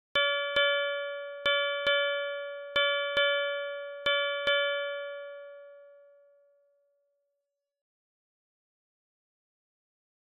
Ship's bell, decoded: 8

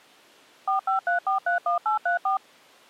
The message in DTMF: 453431834

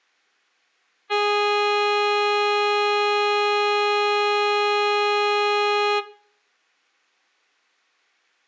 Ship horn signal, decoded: 1 long

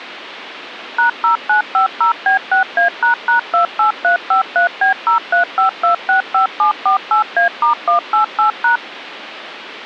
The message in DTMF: #0950B6A##28353B035265748A*188#

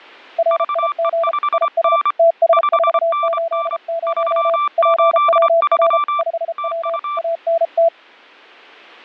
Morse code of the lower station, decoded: RIG IS TS480 PWR 5W ANT

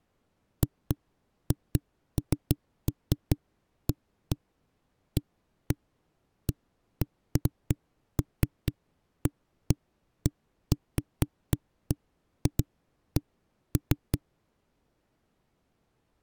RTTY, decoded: none

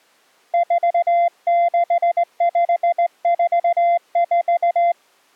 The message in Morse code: 46544

